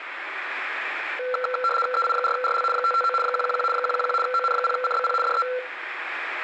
RTTY (75 baud, 850 Hz shift), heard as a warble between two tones, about 930 Hz centre, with radio static and room echo. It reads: EI4RL 559 111 111 ON0CBP DE